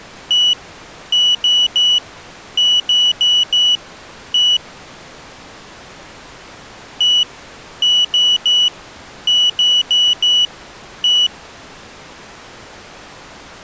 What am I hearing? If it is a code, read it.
Beep code, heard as a piezo beeper, played twice, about 2950 Hz. 1-3-4-1. In Phoenix BIOS tables: memory failure on an address line.